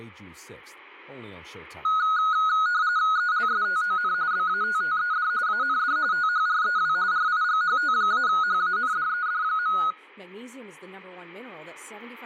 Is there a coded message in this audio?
Yes: RTTY (45.45 baud, 170 Hz shift) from 1.8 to 9.9 s, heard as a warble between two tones, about 1360 Hz centre, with speech in English. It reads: ELSTON BATTED AND THREW RIGHT-HANDED.